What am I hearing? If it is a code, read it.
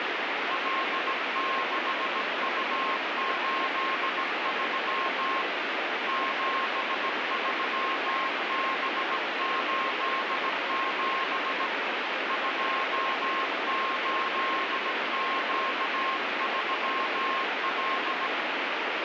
Morse code, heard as a keyed tone, hand-sent with a bug key, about 17 wpm, 1070 Hz, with heavy radio static. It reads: L6U83 73B87 28Q3L